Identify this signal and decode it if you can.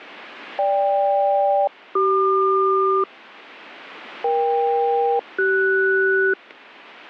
Aircraft SELCAL, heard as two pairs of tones. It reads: GK-CQ EK-CS